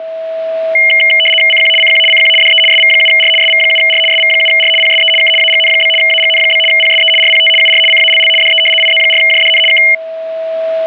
RTTY (75 baud, 850 Hz shift), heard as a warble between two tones, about 2550 Hz centre, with a steady whistle near 650 Hz. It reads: CQ CQ CQ DE SV7R SV7R SV7R PSE K AGN? AGN? PSE RPT UR CALL DE IZ4JDN K